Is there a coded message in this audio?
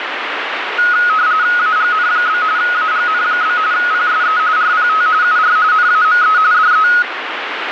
Yes: RTTY (45.45 baud, 170 Hz shift) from 0.8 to 7.0 s, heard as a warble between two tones, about 1360 Hz centre, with radio static. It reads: AGN? AGN? PSE RPT UR NAME DE